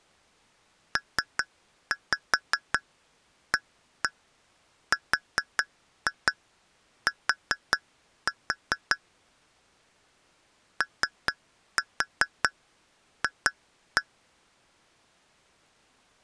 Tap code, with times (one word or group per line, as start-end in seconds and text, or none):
1.0-9.0 PART
10.8-14.0 OF